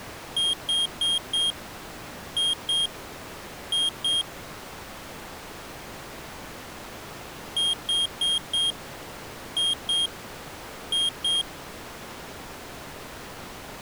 Beep code, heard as a piezo beeper, played twice, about 3250 Hz. 4-2-2. In Phoenix BIOS tables: shutdown test failure.